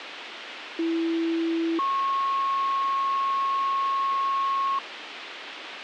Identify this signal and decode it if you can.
Two-tone page, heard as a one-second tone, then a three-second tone, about 330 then 1090 Hz, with radio hiss and a squelch burst at the end.